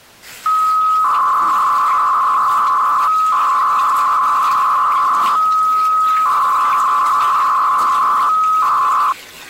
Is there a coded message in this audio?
Yes: 300-baud modem data (Bell 103 tones) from 0.5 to 9.1 s, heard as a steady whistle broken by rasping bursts, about 300 baud, 200 Hz shift, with kitchen noise.